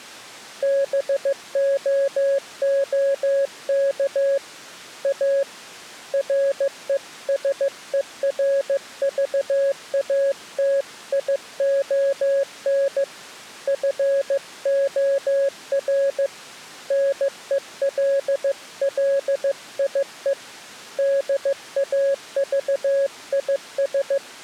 Morse code, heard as a keyed tone, hand-sent with a paddle, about 15 wpm, 550 Hz. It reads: BOOK A RESERVATION FOR NELLIE DAVIS